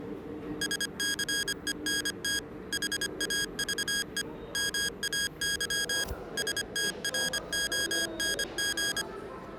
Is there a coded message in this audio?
Yes: Morse code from 0.6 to 9.1 s, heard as electronic beeps, machine-sent, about 25 wpm, 1650 Hz, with the noise of a subway station. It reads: SCENT HAVE MAY STRONG